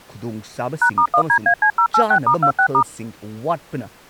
DTMF, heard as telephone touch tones, dialled by machine, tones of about 80 ms, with speech in Manipuri. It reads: #*1DAC086*26*